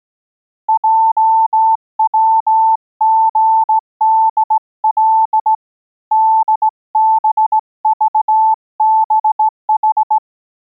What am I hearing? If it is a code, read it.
Morse code, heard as a keyed tone, hand-sent with a straight key, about 17 wpm, 880 Hz. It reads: JWGDL DBVBH